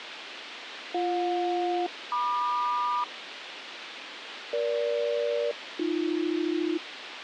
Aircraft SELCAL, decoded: BJ-MQ EG-AB

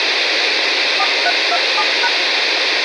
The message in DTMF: 4327#

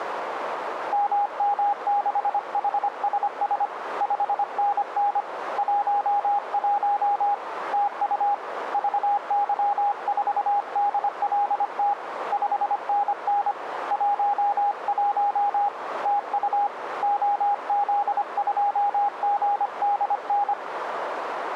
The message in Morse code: MM6HSS 5NN 11 TU VY4DLT 5NN 11 TU OZ2GDN

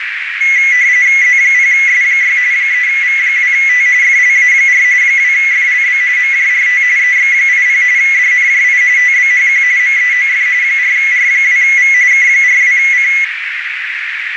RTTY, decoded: Z0S6 3V2T FLA4 2FLB MJRT EX80 DNJI TBHQ MEOF 4R2V K42C

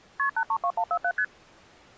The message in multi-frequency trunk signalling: KP 832147 ST

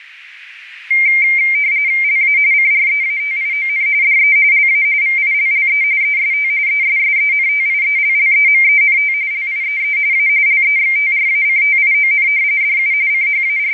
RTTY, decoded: LA CREATION DE LA VILLE EST ESSENTIELLEMENT LIEE A LEXTRACTION DU …

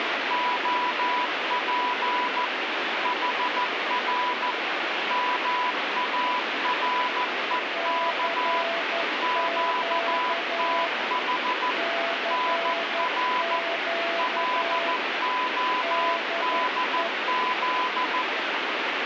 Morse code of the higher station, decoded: OP HR MAREK QTH NR LODZ

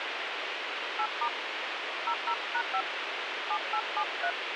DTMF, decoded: 8* 00#5 7873

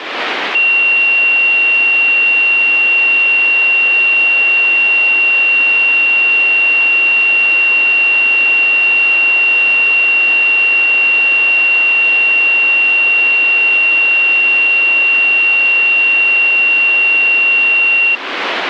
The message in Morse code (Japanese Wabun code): none

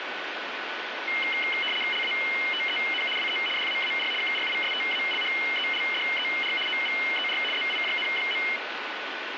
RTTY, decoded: LATEN WE DAAR KRISTALHELDER OVER ZIJN.

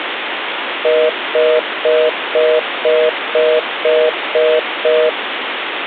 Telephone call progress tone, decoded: congestion tone

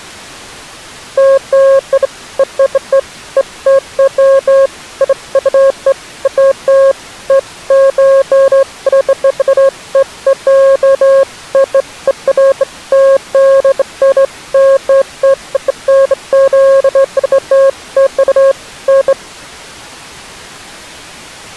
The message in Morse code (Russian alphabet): none

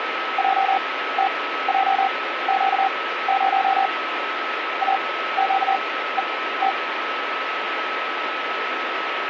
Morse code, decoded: JTJQ0 AQET

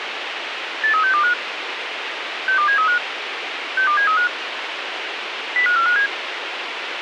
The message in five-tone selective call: 83625 62735 62735 05457

